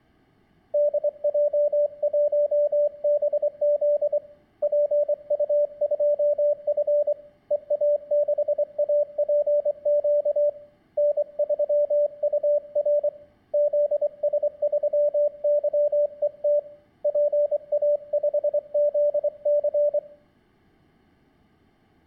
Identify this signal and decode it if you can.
Morse code, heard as a keyed tone, hand-sent with a straight key, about 24 wpm, 590 Hz, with room echo. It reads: DJ1BZ PU2F EA6APQ N3UR ZS3YET PA5ZC